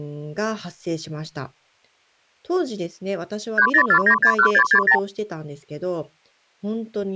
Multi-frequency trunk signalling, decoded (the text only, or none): 304961660